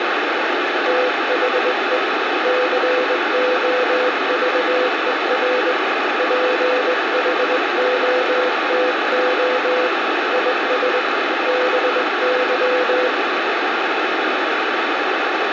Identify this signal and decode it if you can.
Morse code, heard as a keyed tone, hand-sent with a straight key, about 20 wpm, 500 Hz, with heavy radio static. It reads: THE COVER PHOTO IS BY